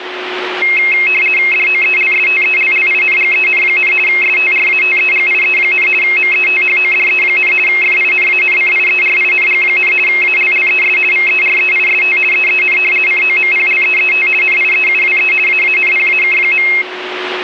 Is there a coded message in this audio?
Yes: RTTY (50 baud, 450 Hz shift) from 0.6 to 16.8 s, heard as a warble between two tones, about 2350 Hz centre, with radio static and a steady whistle near 370 Hz. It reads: DOELSTELLINGEN, STRATEGIE, METHODE, FINANCIERING, ALLES VEREIST EEN COMPLEET NIEUWE AANPAK.